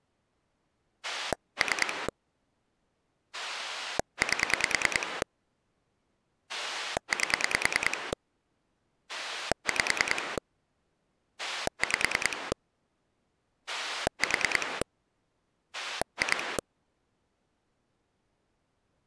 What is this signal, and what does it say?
Pulse dialling, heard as a rotary dial, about 10 pulses a second. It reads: 3 8 8 5 5 4 2